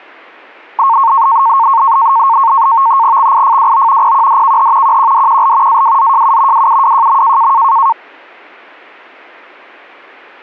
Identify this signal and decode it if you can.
NAVTEX (SITOR-B), 100 baud, 170 Hz shift, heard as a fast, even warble, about 1000 Hz centre. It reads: XIFWO PQDKH QQDQL AWZJU WUWJM